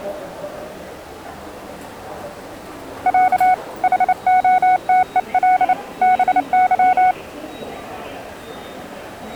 Morse code (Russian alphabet), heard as a keyed tone, hand-sent with a paddle, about 29 wpm, 740 Hz, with the noise of a subway station. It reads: Я ХОТЕЛ БЫ